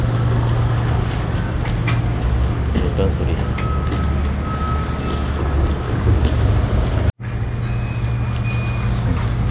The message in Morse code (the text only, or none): none